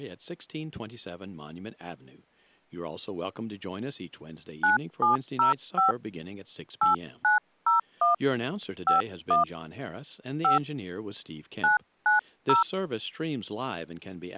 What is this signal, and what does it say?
DTMF, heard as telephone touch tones, dialled by hand, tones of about 140 ms, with speech in English. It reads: 9705 8901 51 5 990